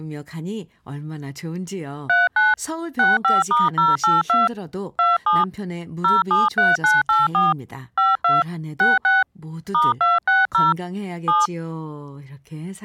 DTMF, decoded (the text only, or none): 39 65*082 27 073984 52 66 *260 7